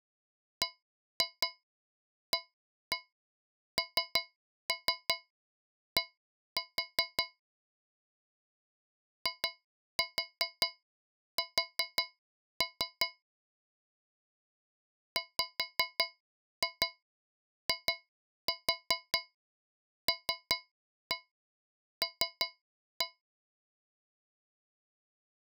Tap code, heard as taps on a metal pipe, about 5 knocks a second. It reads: BAND IS WILL